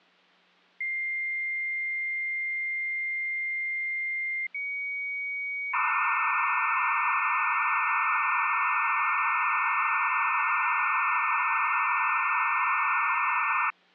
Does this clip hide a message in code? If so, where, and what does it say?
Yes: dial-up modem handshake (low-speed, two carriers) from 0.8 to 13.7 s, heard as two whistles, then hiss.